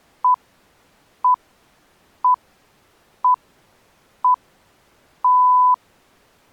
Radio time signal (six pips, as the Greenwich Time Signal), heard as pips.